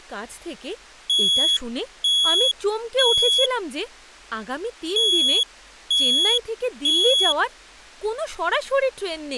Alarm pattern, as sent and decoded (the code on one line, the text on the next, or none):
3 beeps and a pause
temporal three